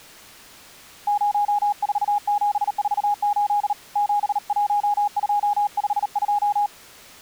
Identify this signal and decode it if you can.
Morse code, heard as a keyed tone, hand-sent with a paddle, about 38 wpm, 820 Hz. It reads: 04748 71252